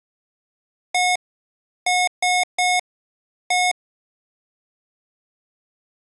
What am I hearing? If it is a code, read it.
Beep code, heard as beeps from a small speaker, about 720 Hz. 1-3-1. In Phoenix BIOS tables: memory refresh failure.